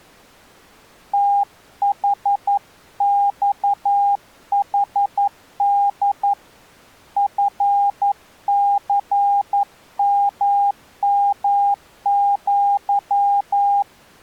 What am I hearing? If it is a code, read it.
Morse code (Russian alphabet), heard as a keyed tone, hand-sent with a paddle, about 11 wpm, 810 Hz. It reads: ТХЬХД ФЦММЪ